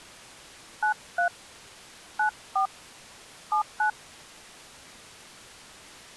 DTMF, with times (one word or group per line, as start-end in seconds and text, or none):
0.8-1.3 93
2.2-2.7 94
3.5-3.9 79